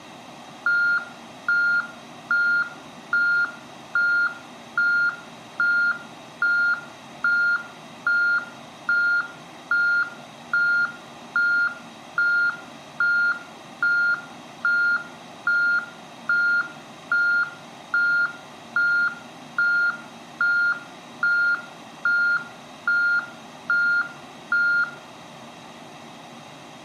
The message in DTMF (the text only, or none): none